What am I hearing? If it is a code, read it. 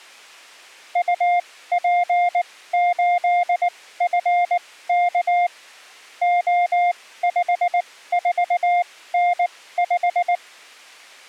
Morse code, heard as a keyed tone, machine-sent, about 19 wpm, spaced as for 15 wpm, 710 Hz. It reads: UP8FK O54N5